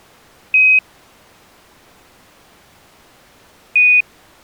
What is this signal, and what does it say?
Quindar tones, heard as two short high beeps.